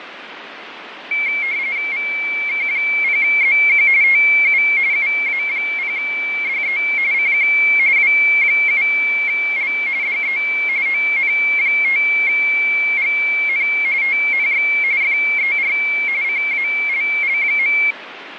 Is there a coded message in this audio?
Yes: RTTY (45.45 baud, 170 Hz shift) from 1.1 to 17.9 s, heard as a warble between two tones, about 2250 Hz centre, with radio static and fading. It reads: VK0ZQ TU UA0DE CQ W7L DE ON5GN TNX FER CALL.